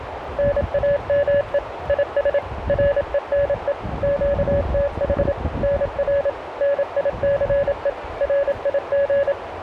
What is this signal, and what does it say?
Morse code, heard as a keyed tone, machine-sent, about 27 wpm, 570 Hz, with radio static, a narrow filter and the noise of a residential street. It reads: NAME IS RENE QTH NR NICE RIG